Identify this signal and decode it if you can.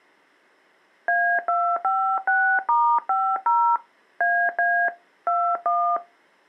DTMF, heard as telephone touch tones, dialled by hand, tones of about 290 ms. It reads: A256*50 AA 21